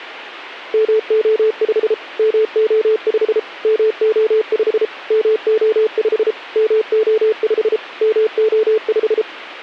Morse code, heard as a keyed tone, machine-sent, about 33 wpm, 440 Hz. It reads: MO5 MO5 MO5 MO5 MO5 MO5